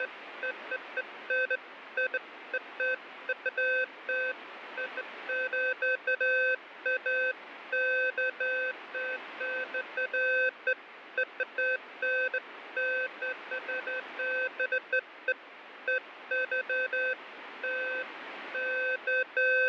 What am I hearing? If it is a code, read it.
Beeps of irregular length, with radio static. There is no code.